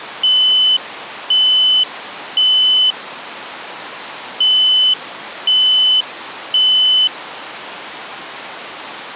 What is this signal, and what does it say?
Alarm pattern, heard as an alarm's beeps, played twice, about 3000 Hz. Temporal three. Smoke or fire, evacuate.